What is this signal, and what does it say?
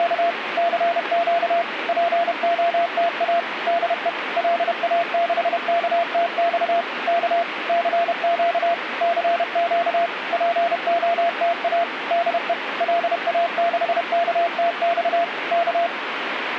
Morse code, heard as a keyed tone, machine-sent, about 31 wpm, 680 Hz, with radio static. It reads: … CQ POTA DE LA6KTX K CQ CQ POTA DE LA6KTX K